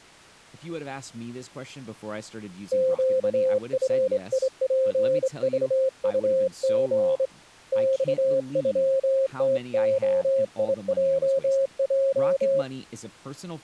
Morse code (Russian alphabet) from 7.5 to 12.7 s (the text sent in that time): ЬЮТОИЙЙ